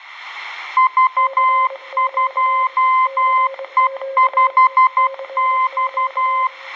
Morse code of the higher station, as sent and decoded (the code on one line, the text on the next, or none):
...- ..--- . ..... -..-
V2E5X